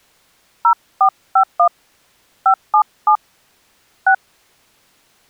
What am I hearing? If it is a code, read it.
DTMF, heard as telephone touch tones, dialled by hand, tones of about 80 ms. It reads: 0451 577 6